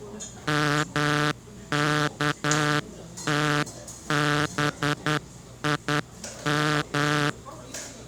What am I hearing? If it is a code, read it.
Morse code (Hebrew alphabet), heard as a buzzer, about 10 wpm, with the noise of a cafe. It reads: מכתבים